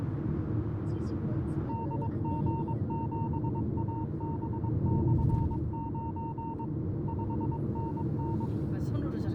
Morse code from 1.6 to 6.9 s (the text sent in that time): DG7AB/9